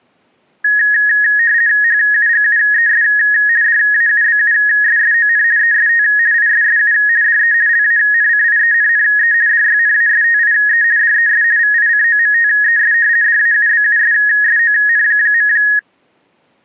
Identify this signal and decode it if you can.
RTTY (50 baud, 170 Hz shift), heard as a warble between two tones, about 1750 Hz centre. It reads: HUGUES DAUBUSSON EST ISSU DE LANCIENNE DYNASTIE DES VICOMTES DAUBUSSON.